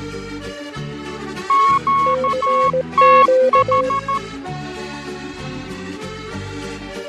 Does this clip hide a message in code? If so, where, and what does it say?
Yes: Morse code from 1.4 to 4.2 s, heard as two keyed tones, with fading. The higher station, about 13 wpm, 1100 Hz: QTH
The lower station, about 18 wpm, 520 Hz: CQ